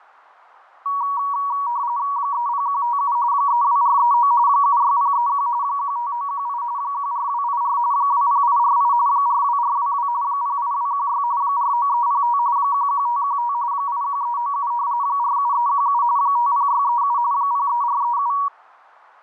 RTTY (45.45 baud, 170 Hz shift), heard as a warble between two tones, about 1040 Hz centre, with fading. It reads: 30157 32439 76031 15918 14284 20848 42422 08216 49305 11515 81397 47317 50637 03437